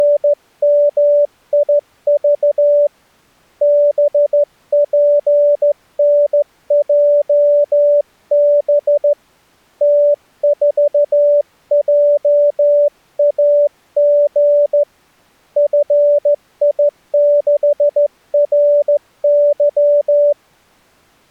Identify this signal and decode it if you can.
Morse code, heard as a keyed tone, hand-sent with a straight key, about 14 wpm, 580 Hz. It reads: … BPNJB T4JAG FI6RY